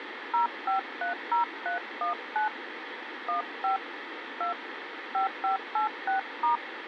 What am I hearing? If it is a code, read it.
DTMF, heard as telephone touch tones, dialled by hand, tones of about 120 ms, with radio hiss. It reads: 0530319 15 2 5586*